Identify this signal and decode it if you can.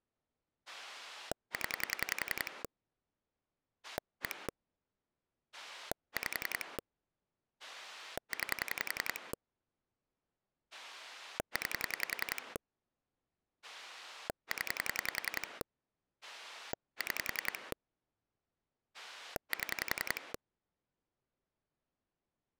Pulse dialling, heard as a rotary dial, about 10 pulses a second. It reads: 0 1 5 9 9 0 6 7